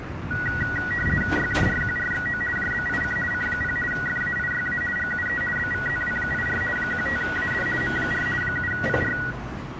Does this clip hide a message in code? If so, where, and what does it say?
Yes: RTTY (50 baud, 450 Hz shift) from 0.3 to 9.3 s, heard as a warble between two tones, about 1700 Hz centre, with room echo and street noise. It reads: YJRQRXO JBIC C0 FAIYA GUE BVZW84 15AD M4 7PR